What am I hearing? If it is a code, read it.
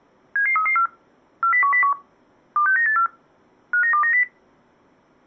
Five-tone selective call (CCIR), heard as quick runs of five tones, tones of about 100 ms. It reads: 77334 40101 26984 59290